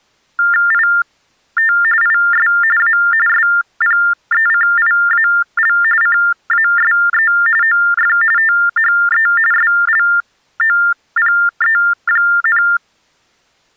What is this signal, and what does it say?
TTY/TDD text telephone tones (45.45 baud Baudot), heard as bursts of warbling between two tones, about 400 Hz shift, 1600 Hz centre. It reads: IT IS A SPECIAL CASE OF THE SLOPE,